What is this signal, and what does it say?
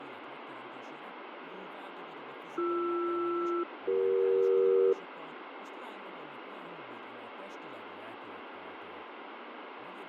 Aircraft SELCAL, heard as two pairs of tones, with radio static, fading and speech in Hungarian. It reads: BR-CE